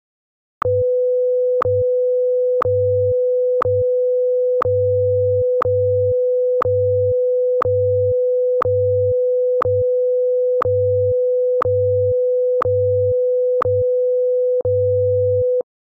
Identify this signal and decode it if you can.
Radio time signal (WWVH, Hawaii), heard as ticks, one a second.